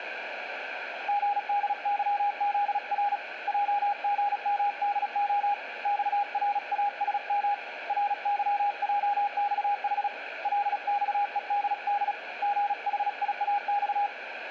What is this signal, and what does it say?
Morse code (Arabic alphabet), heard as a keyed tone, hand-sent with a paddle, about 36 wpm, 820 Hz, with radio static and room echo. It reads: غدظذر جغمدخ صراسم رظجصح لصءدد غحياص